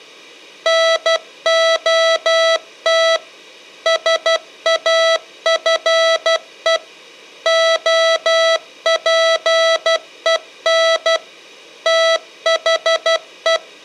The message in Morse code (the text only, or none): NOT SAFE OPEN THE